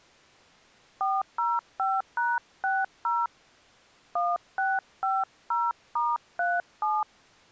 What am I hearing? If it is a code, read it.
DTMF, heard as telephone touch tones, dialled by hand, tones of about 210 ms. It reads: 405#60 1650*37